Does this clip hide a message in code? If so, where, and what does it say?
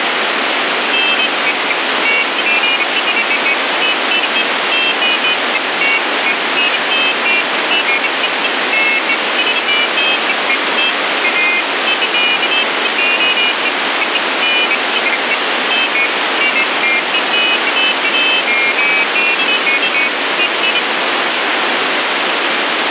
No, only pairs of high tones at irregular times, with heavy radio static.